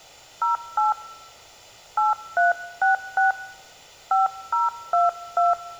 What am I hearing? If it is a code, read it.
DTMF, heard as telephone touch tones, dialled by hand, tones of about 150 ms. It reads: 08 8366 5022